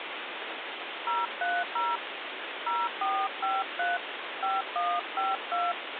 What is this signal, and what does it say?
DTMF, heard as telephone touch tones, dialled by hand, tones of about 220 ms, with phone line noise. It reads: 030 0453 5152